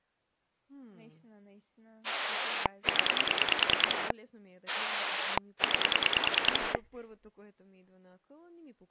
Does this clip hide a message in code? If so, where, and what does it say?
Yes: pulse dialling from 2.0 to 6.8 s, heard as a rotary dial, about 10 pulses a second, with speech in Bulgarian. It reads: 0 9